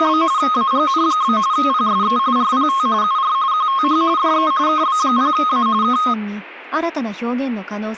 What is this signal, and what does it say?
RTTY (45.45 baud, 170 Hz shift), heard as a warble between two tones, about 1160 Hz centre. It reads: … AGN? PSE RPT UR QTH DE KB0A K